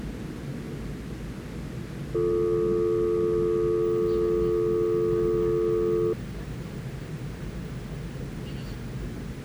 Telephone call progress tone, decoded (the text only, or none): dial tone